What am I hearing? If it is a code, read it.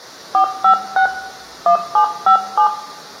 DTMF, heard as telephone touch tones, dialled by hand, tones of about 100 ms, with room echo. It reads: 456 1757